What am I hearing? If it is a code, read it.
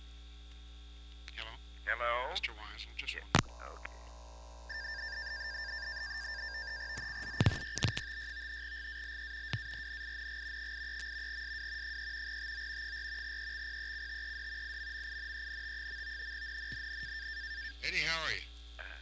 NAVTEX (SITOR-B), 100 baud, 170 Hz shift, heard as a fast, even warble, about 1700 Hz centre, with static crashes. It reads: ZCZC YB56 GALE WARNING 83. SW 3 TO 4 EXPECTED IMMINENT. NNNN